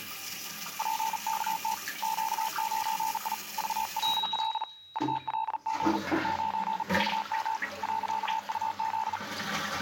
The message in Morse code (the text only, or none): PKT Q9I VLL ULG 9VM .UZ